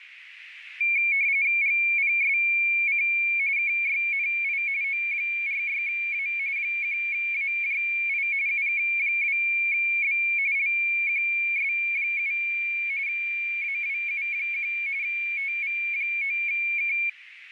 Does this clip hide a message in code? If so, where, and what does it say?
Yes: RTTY (45.45 baud, 170 Hz shift) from 0.8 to 17.1 s, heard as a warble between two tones, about 2300 Hz centre, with radio static. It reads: GPSC KYNI O46A 1AJI UK2B LQS7 AWU1 TV9K